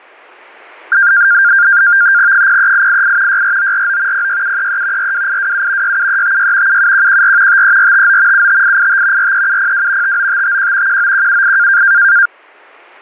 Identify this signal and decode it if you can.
NAVTEX (SITOR-B), 100 baud, 170 Hz shift, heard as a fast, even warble, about 1500 Hz centre. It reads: 03888 64949 06733 42827 67356 77114 53459 75885 43702 59551 19178